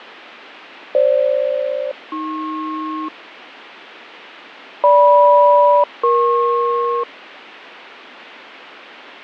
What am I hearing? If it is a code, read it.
Aircraft SELCAL, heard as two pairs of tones, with radio static and fading. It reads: FG-AP GM-EP